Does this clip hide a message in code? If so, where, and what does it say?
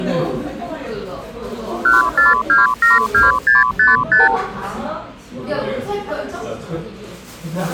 Yes: multi-frequency trunk signalling (R2, with the far end's replies) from 1.9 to 4.4 s, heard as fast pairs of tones, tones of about 160 ms, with the noise of a cafe. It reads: 14272655